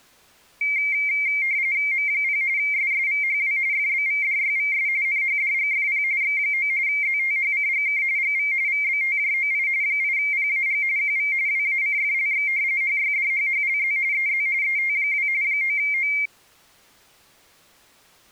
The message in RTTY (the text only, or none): M0 SSVHW FBVDYVS NHDGFP X9 ZTHCGK GV VBTJOI 8PAG QV WACFLX HYDHHLZ EZ ET2 9O